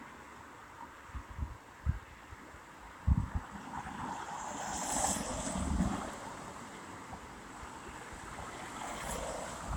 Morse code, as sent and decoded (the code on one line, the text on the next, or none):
none